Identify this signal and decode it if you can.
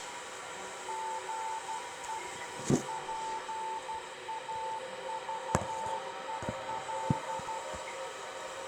Morse code, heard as a keyed tone, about 12 wpm, 890 Hz, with radio static, room echo and the noise of a restroom. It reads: GE PAVEL